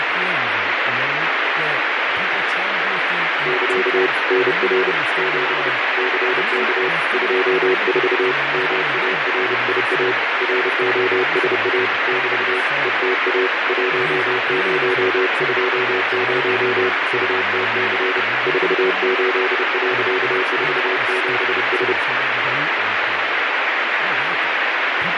Morse code, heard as a keyed tone, hand-sent with a paddle, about 30 wpm, 380 Hz, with heavy radio static, fading and speech in English. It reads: <KA> NR 7 CK 24 MARIA ROSA <BT> ETA 1020 UTC 48.47S